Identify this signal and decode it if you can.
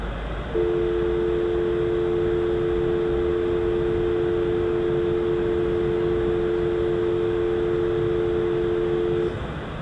Telephone call progress tone (North American or UK plan), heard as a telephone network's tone, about 350, 440 Hz, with phone line noise, room echo and the noise inside a subway train. Dial tone.